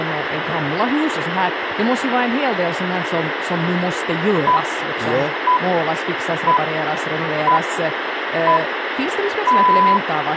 Radio time signal (six pips, as the Greenwich Time Signal), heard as pips, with radio hiss, a squelch burst at the end and speech in Swedish.